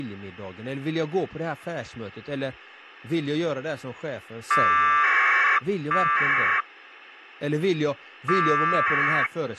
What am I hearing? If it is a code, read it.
Packet radio (AX.25, as in APRS), 1200 baud, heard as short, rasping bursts, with speech in Swedish.